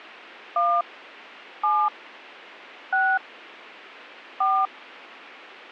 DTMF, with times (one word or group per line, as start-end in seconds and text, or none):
0.6-0.8 1
1.6-1.9 7
2.9-3.2 6
4.4-4.7 4